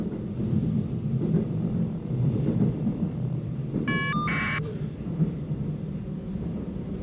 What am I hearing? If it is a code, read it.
Caller ID data burst, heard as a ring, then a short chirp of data, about 1200 baud, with the noise inside a subway train.